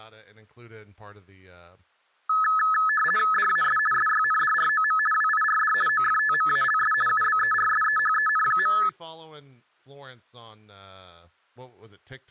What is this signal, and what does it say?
RTTY (50 baud, 450 Hz shift), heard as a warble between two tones, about 1500 Hz centre, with speech in English. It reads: DAS SYNDROM WIRD OFTMALS UBERSEHEN.